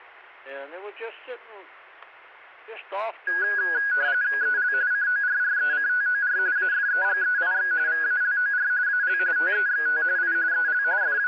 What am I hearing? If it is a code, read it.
RTTY (45.45 baud, 170 Hz shift), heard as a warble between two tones, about 1550 Hz centre, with static crashes. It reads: EL CORRECTOR AFEGEIX VALOR AL TEXT I EL …